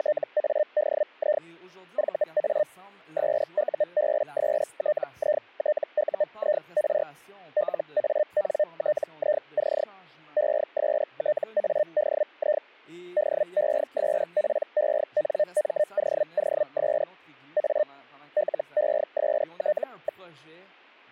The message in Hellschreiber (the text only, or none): … VA SUBSTITUIR LANTIC ESTADI DESPENMOOS A LEST.